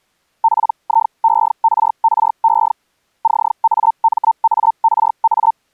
Hellschreiber (Feld-Hell, 122.5 baud), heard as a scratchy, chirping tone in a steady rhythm, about 900 Hz. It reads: PIERRE CAMARA